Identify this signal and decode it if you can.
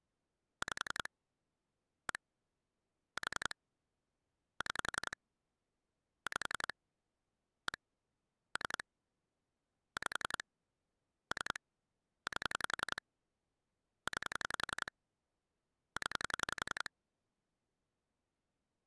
Pulse dialling, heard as clicks on a phone line, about 11 pulses a second. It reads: 5 1 4 6 5 1 3 5 3 8 9 0